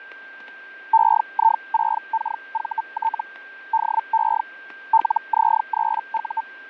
Hellschreiber (Feld-Hell, 122.5 baud), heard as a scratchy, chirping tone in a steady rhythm, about 900 Hz, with fading, static crashes and a steady whistle near 1580 Hz. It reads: EI6KVT DE LZ3U